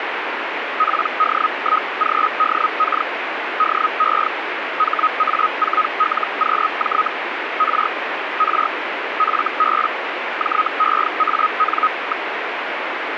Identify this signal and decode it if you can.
Hellschreiber (Feld-Hell, 122.5 baud), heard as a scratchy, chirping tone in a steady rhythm, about 1260 Hz, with radio static. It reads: PD1GDK DE HA4LQJ R R FB JEAN.